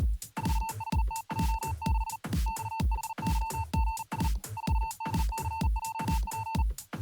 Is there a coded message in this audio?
Yes: Morse code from 0.3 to 6.7 s, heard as a keyed tone, hand-sent with a paddle, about 40 wpm, 900 Hz. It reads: 4HTJ6 XHYGS 4DCJP